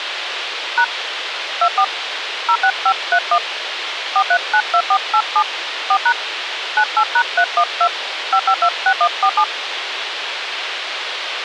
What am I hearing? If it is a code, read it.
DTMF, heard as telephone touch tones, dialled by hand, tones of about 70 ms, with radio hiss. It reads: # 24 06531 4392487 4# 98#312 5526147